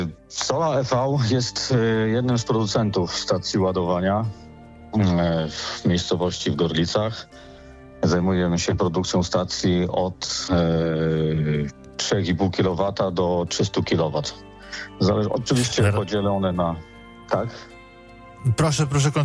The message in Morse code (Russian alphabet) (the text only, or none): none